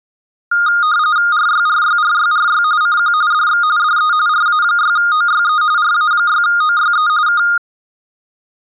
RTTY (45.45 baud, 170 Hz shift), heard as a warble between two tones, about 1320 Hz centre. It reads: RYRYRYRY CQ DX DE RA6OYE RA6OYE K